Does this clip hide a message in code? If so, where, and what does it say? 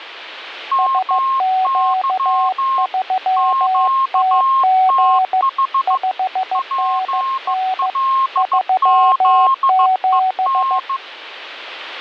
Yes: Morse code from 0.7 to 11.0 s, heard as two keyed tones, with radio static. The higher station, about 15 wpm, 1070 Hz: MY QTH PLZEN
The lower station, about 15 wpm, 750 Hz: SQ3TG 5NN 37